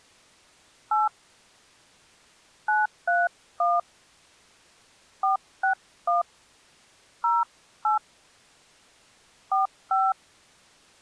DTMF, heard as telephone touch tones, dialled by hand, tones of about 150 ms. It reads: 8 931 461 08 45